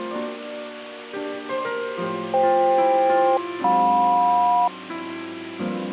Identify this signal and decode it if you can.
Aircraft SELCAL, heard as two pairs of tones. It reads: FK-JM